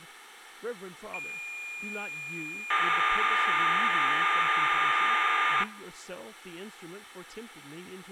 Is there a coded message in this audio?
Yes: cassette data (Kansas City type), 1200 baud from 1.1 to 5.6 s, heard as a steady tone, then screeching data, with speech in English.